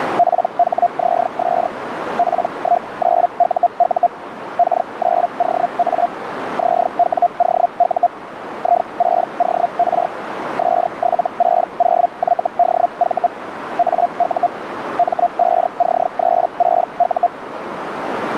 Hellschreiber (Feld-Hell, 122.5 baud), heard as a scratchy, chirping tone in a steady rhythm, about 700 Hz, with radio static and a narrow filter. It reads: PHZS P19UU K9OA ZWOU I6OR S760YDV AU M5C36U